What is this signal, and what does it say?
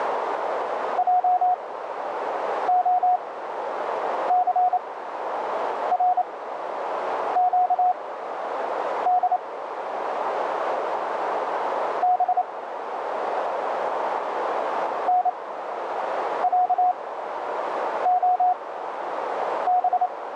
Morse code (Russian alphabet), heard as a keyed tone, machine-sent, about 28 wpm, spaced as for 7 wpm, 730 Hz, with radio static and a narrow filter. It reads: ЙОЦРЩД Б НЯОБ